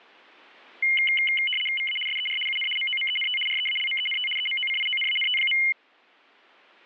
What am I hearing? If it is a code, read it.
RTTY (75 baud, 850 Hz shift), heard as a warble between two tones, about 2550 Hz centre. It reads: VA SER UN MOMENT REALMENT EMOCIONANT.